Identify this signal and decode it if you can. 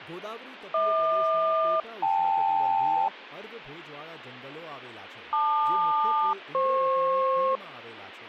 Aircraft SELCAL, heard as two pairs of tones, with speech in Gujarati. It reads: HQ-KL LQ-FP